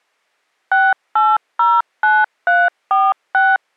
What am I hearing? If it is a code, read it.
DTMF, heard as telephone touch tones, dialled by machine, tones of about 210 ms. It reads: 6809346